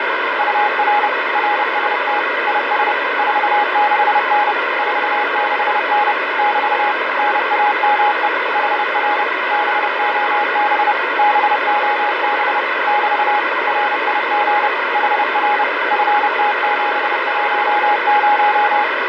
Morse code, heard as a keyed tone, machine-sent, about 30 wpm, 830 Hz, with heavy radio static. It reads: UR RST IS 46N 46N <BT> NAME HR BOB BOB <BT> RIG HR FT710